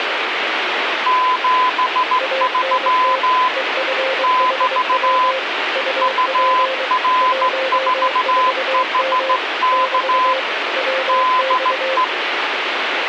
Morse code, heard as two keyed tones, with radio static. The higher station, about 15 wpm, 1020 Hz: 73 <BT> UR4HK DE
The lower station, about 23 wpm, 530 Hz: ANT EFHW UP 14M <BT> WX